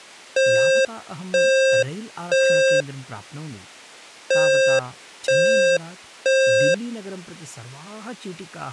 Alarm pattern, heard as an alarm's beeps, played twice, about 530 Hz, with speech in Sanskrit. Temporal three. Smoke or fire, evacuate.